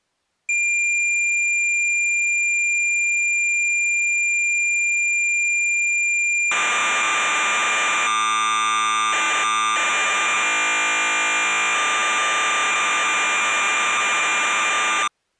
Cassette data (Kansas City type), 1200 baud, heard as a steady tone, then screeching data.